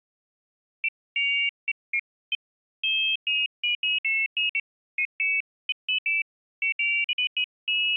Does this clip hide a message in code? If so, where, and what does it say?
No, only pairs of high tones at irregular times.